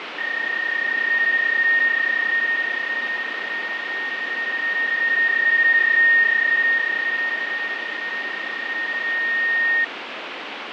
PSK31 (31.25 baud), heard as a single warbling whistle, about 1850 Hz, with radio static and fading.